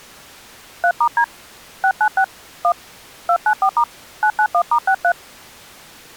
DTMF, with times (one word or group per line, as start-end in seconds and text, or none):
0.8-1.2 3*D
1.8-2.2 696
2.6-2.7 1
3.3-3.8 294*
4.2-5.1 991*63